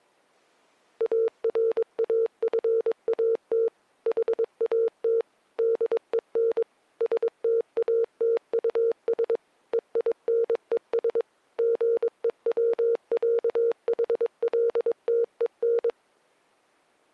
Morse code (with German letters), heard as a keyed tone, machine-sent, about 22 wpm, 460 Hz. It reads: ARAFAT HAT DEN STATUS EINES GEWÄHLTEN